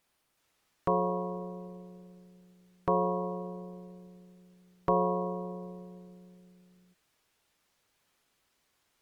Clock strike, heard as a bell. 3. Three o'clock.